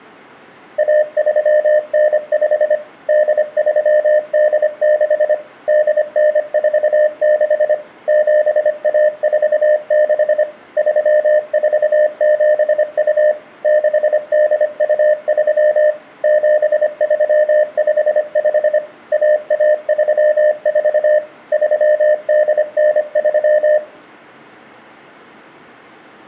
Morse code (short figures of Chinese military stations), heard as a keyed tone, machine-sent, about 25 wpm, 610 Hz. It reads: 1395 8386 8946 7146 3472 6823 7355 1134 3893